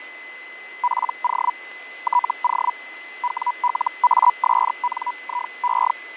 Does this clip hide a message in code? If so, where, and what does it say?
Yes: Hellschreiber (Feld-Hell, 122.5 baud) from 0.8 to 5.9 s, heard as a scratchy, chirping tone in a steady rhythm, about 980 Hz, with radio static, fading and a steady whistle near 2030 Hz. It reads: PO TO WLASNIE